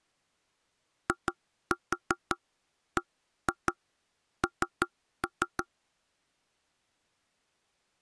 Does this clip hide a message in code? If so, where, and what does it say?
Yes: tap code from 1.1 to 5.7 s, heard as knocks on wood, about 5 knocks a second. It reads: IBN